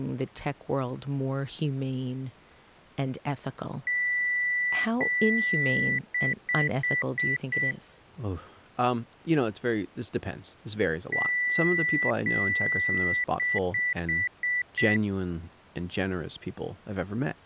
Beep code, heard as beeps, played twice, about 1950 Hz, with speech in English. 2 long, 5 short.